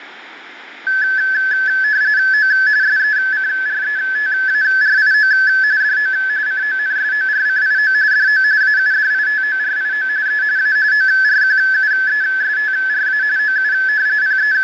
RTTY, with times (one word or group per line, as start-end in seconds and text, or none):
2.3-2.5 O
2.8-5.3 SECRETARIO
5.8-6.1 DO
6.5-7.9 CONSORCIO
8.1-8.4 DO
8.6-10.1 AUDITORIO
10.3-10.4 E
10.6-10.8 A
10.9-13.2 ORQUESTRA
13.4-13.7 OU
14.2-14.6 …